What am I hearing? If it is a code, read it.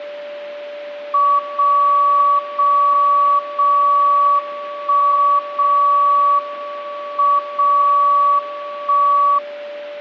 Radio time signal (WWVB), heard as a tone whose level steps once a second, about 1140 Hz, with a steady whistle near 580 Hz. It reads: 0 0 0 1 0 M 0 1